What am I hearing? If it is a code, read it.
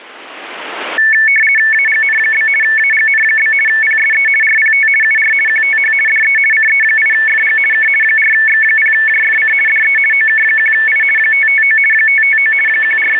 RTTY (50 baud, 450 Hz shift), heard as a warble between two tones, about 2000 Hz centre. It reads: AGN? AGN? PSE RPT UR QTH DE CE8FG K 4X0JFC DE OK1I 559 559 …